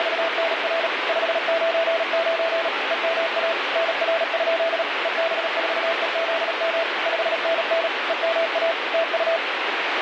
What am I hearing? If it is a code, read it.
Morse code, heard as a keyed tone, machine-sent, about 37 wpm, 660 Hz, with heavy radio static. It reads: … 599 EMA NR? EB4EZM 5NN EMA TU